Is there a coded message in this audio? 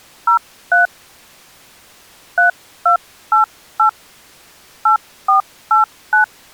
Yes: DTMF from 0.3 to 6.2 s, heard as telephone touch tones, dialled by hand, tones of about 110 ms. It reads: 03 3288 8489